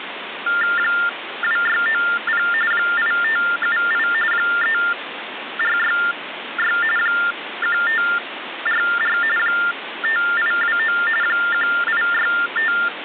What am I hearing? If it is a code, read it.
TTY/TDD text telephone tones (45.45 baud Baudot), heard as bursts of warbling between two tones, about 400 Hz shift, 1600 Hz centre, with phone line noise. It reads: 2690 8578 3466 1544 5829 1865